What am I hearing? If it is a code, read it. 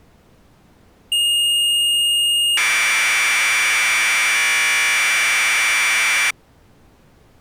Commodore tape loading (standard loader), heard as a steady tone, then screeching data.